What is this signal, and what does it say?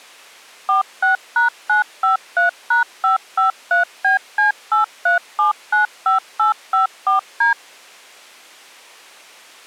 DTMF, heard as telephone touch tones, dialled by machine, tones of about 130 ms. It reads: 46#953#553BC83795854D